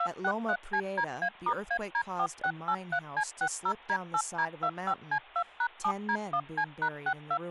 DTMF, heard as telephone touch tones, dialled by machine, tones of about 70 ms, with speech in English. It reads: 263CDA*AD4683C60D8D25C2#7D1C#62